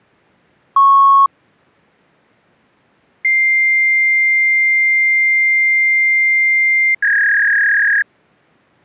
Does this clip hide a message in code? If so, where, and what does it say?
Yes: fax machine handshake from 0.8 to 8.0 s, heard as a beep, a long tone and a warble.